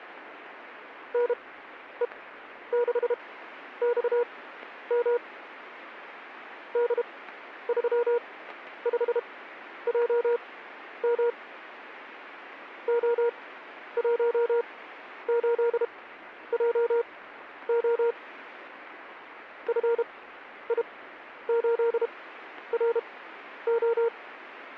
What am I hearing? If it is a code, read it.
Morse code, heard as a keyed tone, machine-sent, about 32 wpm, spaced as for 11 wpm, 470 Hz. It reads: NE6XM D35JM O18JO FI8RO